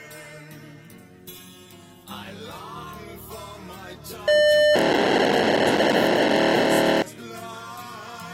POCSAG pager data (1200 baud), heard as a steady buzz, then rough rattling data.